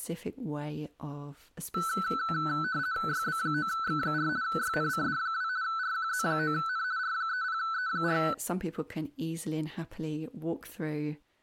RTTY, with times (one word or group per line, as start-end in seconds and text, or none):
3.1-4.3 YB9X4
4.4-5.5 YNCD2
5.6-6.8 RQZ9N
7.0-8.2 R30E4